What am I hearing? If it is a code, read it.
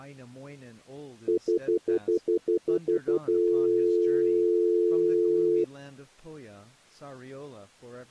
Telephone call progress tone (North American plan), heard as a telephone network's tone, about 350, 440 Hz, 0.1 s on and 0.1 s off, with speech in English. Stutter dial tone.